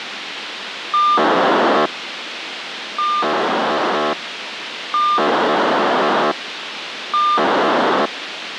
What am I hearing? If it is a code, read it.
POCSAG pager data (2400 baud), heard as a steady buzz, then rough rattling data, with radio hiss.